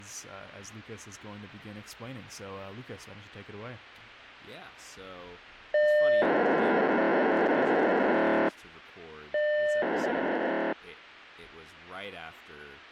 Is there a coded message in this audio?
Yes: POCSAG pager data (1200 baud) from 5.7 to 10.7 s, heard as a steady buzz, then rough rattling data, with speech in English.